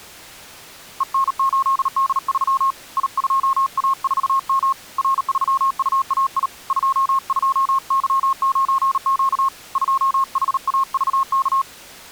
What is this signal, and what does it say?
Morse code, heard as a keyed tone, hand-sent with a paddle, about 38 wpm, 1080 Hz. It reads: EN8D3 I2A4M R3UAI 22Y9Q 2HAVK